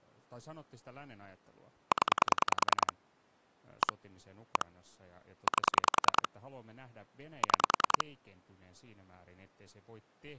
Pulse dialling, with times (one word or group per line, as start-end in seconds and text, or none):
1.9-2.9 0
3.8-3.9 1
4.6-4.7 1
5.5-6.3 8
7.4-8.0 6